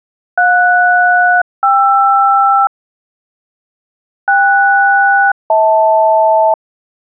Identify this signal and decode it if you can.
Aircraft SELCAL, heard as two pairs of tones. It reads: JS-KR KS-HL